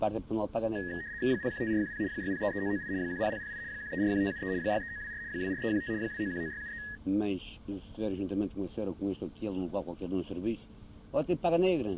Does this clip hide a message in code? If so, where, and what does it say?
Yes: RTTY (75 baud, 170 Hz shift) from 0.8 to 7.0 s, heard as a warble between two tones, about 1800 Hz centre. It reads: 015410 6033998 10008 1341573 63924 24315 2919673